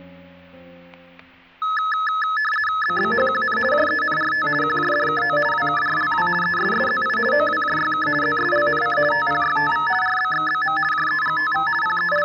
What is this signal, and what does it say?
RTTY (50 baud, 450 Hz shift), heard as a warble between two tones, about 1500 Hz centre, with static crashes. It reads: BBHQN JENRT QJDKO WKRLW ESSZI OWJYK ZSLNC TPYTV RBXBM JEGTV …